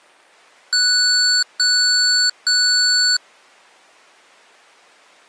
Beep code, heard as beeps from a small speaker, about 1480 Hz. 3 long. In IBM BIOS tables: keyboard card error.